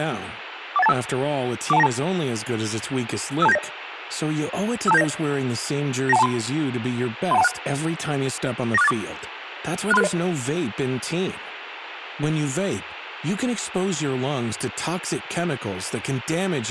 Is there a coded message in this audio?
Yes: five-tone selective call (EIA) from 0.8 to 10.1 s, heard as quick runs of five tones, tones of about 30 ms, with radio hiss and speech in Italian. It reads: 41825 41292 52790 52790 92123 31216 94684 63660